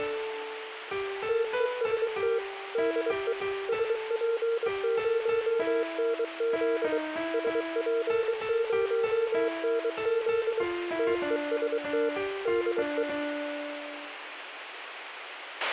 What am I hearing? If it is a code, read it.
Morse code, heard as a keyed tone, machine-sent, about 23 wpm, 460 Hz, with a squelch burst at the end. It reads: TEST DE SP0NZ SP0NZ TEST DE